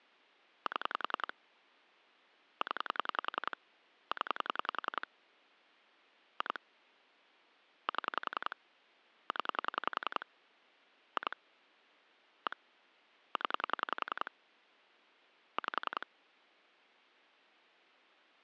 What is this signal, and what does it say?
Pulse dialling, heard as clicks on a phone line, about 10 pulses a second. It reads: 7 0 0 2 7 0 2 1 0 5